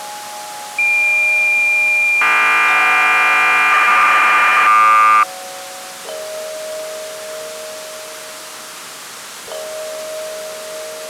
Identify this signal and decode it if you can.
Cassette data (Kansas City type), 1200 baud, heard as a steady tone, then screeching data.